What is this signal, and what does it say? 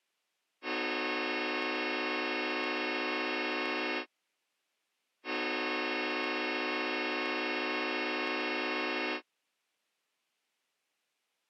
Train horn signal, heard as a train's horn. 2 long. On North American railways: brakes released, proceed.